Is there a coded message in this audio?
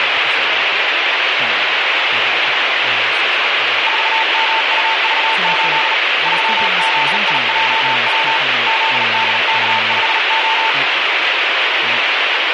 Yes: Morse code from 3.8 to 10.8 s, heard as a keyed tone, hand-sent with a bug key, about 38 wpm, 890 Hz, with heavy radio static and speech in English. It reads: 4MUV8 3ZIJW ZDK5O